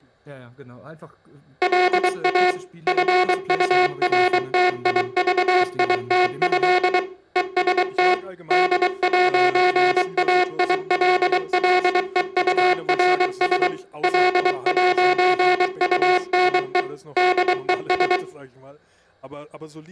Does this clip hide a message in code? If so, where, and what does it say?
Yes: Morse code (with French letters) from 1.6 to 18.2 s, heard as a buzzer, machine-sent, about 23 wpm, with room echo and speech in German. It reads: LA FURTIVITÉ EST D'AILLEURS L'UNE DES